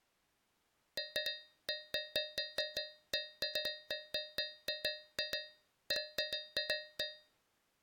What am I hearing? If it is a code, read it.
Irregular taps on a metal pipe. There is no code.